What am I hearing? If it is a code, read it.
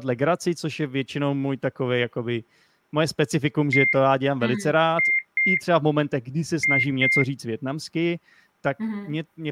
Beep code, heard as beeps, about 2100 Hz, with speech in Czech. 1-2-2. In Phoenix BIOS tables: DMA initialisation failure.